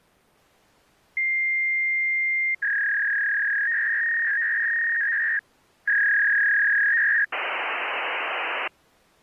Fax machine handshake, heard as a long tone, a warble and hiss.